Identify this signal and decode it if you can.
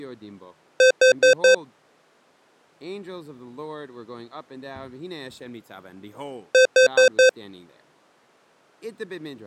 Alarm pattern, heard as an alarm's beeps, played twice, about 520 Hz, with speech in English. Temporal four. Carbon monoxide.